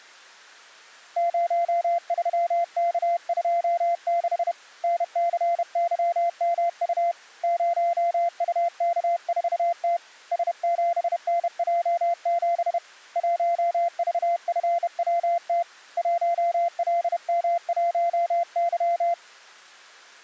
Morse code, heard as a keyed tone, hand-sent with a bug key, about 31 wpm, 690 Hz. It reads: 03K26 NCYMU 0UK4T S7NJ7 1VFWT 1LM1Y